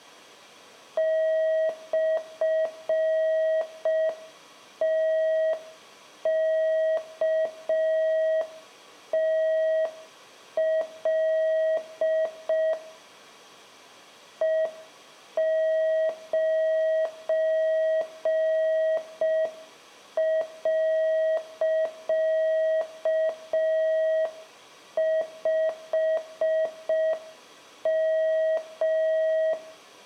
Morse code, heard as a keyed tone, machine-sent, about 5 wpm, 640 Hz, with room echo. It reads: /TKTL E9.5M